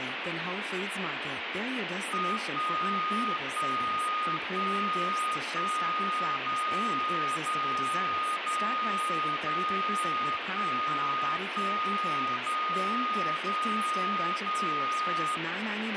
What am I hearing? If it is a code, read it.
Radio time signal (DCF77), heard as a tone whose level steps once a second, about 1240 Hz, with radio static and speech in English. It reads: 1 1 1 1 0 0 0 0 1 1 0 0 0